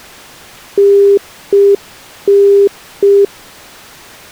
Telephone call progress tone (UK plan), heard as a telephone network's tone, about 400 Hz. Congestion tone.